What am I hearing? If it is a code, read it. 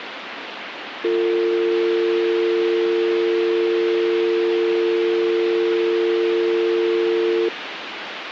Telephone call progress tone (North American or UK plan), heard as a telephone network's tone, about 350, 450 Hz, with phone line noise. Dial tone.